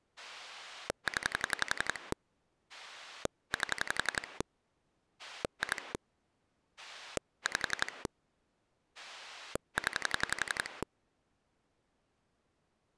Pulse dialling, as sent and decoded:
10 / 8 / 2 / 5 / 10
0 8 2 5 0

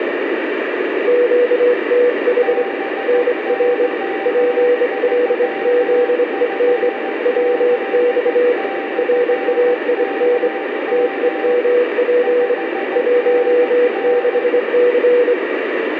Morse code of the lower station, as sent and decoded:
--.- - .... / -. .-. / .--. .-.. --.. . -. / .-- -..- / .-. .- .. -. / - . -- .--. / .---- -.... -.-.
QTH NR PLZEN WX RAIN TEMP 16C

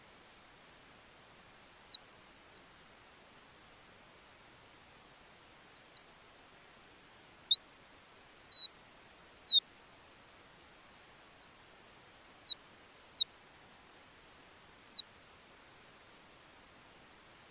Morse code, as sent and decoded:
none

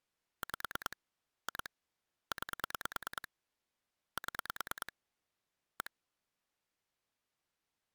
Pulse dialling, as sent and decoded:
5 / 2 / 9 / 7 / 1
5 2 9 7 1

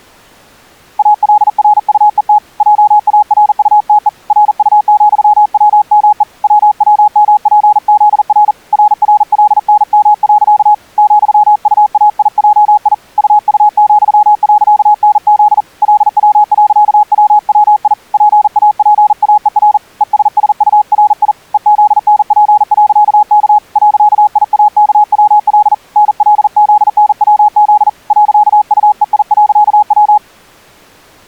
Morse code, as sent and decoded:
.- .-.. .-. ..- . - / .--- .- .-. ..- - . / .-. ..- --..-- .-- -- . / .-- .-- -- .--. --.. .-. / .-. .-. .-.. -. -- .-.-.- / --..-- ..- .- .. .--- .. / ..- ..- --..-- .-.-.- -. --.. / .-.. .-- .-.-.- .-- .-- .. / .--. .- .--. .- . .-. / . ... ... ..- .-. .. / . --.. -. .--. .-.-.- -.- / .-.-.- .. .- -.- .-- .-.. / -. .-.. --.. -. .-- --.. / .-.-.- ..- . .. .-.-.- .--
ALRUET JARUTE RU,WME WWMPZR RRLNM. ,UAIJI UU,.NZ LW.WWI PAPAER ESSURI EZNP.K .IAKWL NLZNWZ .UEI.W

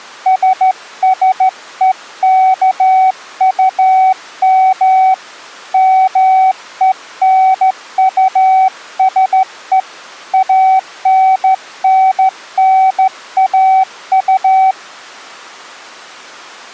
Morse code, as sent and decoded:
... ... . -.- ..- -- / -- . -. ..- ... . / .- -. -. -. .- ..-
SSEKUM MENUSE ANNNAU

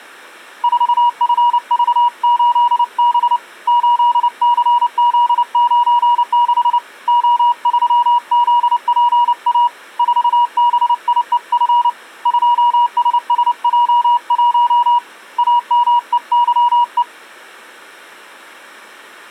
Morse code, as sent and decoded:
....- ..-. ...- ---.. -... / ---.. -.-. --.. ----. -.... / --- ...-- --.. .--. .- / ....- -... .. . ..-. / ..--- ... ... .--- .---- / .- -- . -.-- .
4FV8B 8CZ96 O3ZPA 4BIEF 2SSJ1 AMEYE

